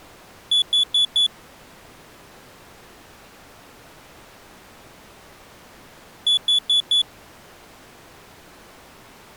Alarm pattern, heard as an alarm's beeps, played twice, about 3450 Hz. Temporal four. Carbon monoxide.